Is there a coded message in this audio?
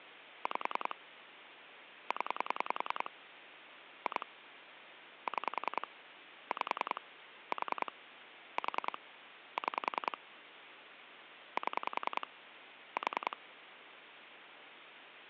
Yes: pulse dialling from 0.5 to 13.3 s, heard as clicks on a phone line, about 10 pulses a second, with phone line noise. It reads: 5 0 2 6 5 4 4 6 7 4